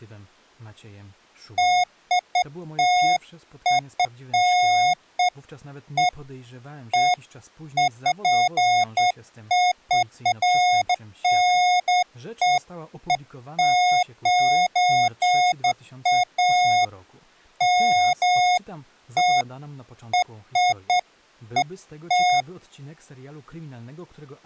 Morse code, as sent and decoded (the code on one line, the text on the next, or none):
none